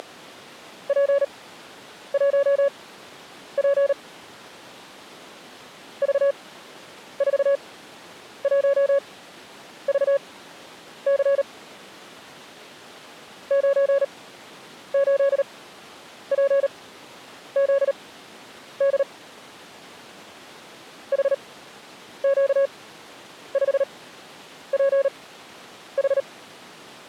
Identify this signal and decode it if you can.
Morse code, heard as a keyed tone, machine-sent, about 38 wpm, spaced as for 9 wpm, 560 Hz. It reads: … V41VC 98PZD HQ5PH